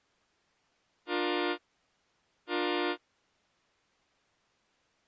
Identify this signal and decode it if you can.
Train horn signal, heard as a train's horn. 2 short. On North American railways: a signal is acknowledged.